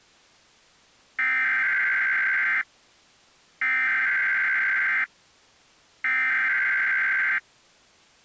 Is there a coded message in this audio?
Yes: Emergency Alert System (SAME) tones (header bursts) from 1.2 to 7.4 s, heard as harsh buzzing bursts, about 520.83 baud.